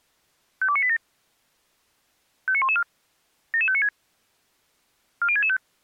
Five-tone selective call (ZVEI), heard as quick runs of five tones, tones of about 70 ms. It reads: 52987 59114 77596 40665